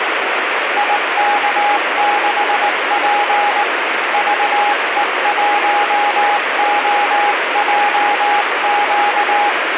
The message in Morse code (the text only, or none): IK6P VE1OJQ